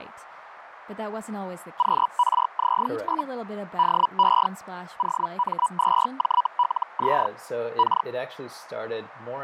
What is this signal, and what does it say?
Hellschreiber (Feld-Hell, 122.5 baud), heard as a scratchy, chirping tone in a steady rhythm, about 980 Hz, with radio static, fading and speech in English. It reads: QRZ? DE OM2JLZ K